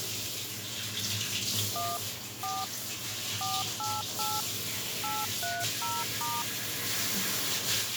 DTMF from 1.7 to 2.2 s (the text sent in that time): 1